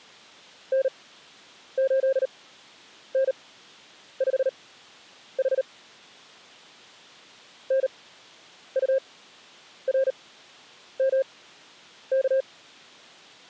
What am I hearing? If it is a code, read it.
Morse code, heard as a keyed tone, machine-sent, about 38 wpm, spaced as for 9 wpm, 540 Hz. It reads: N8N5H NURMK